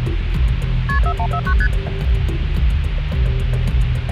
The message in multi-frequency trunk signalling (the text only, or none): KP 4149 ST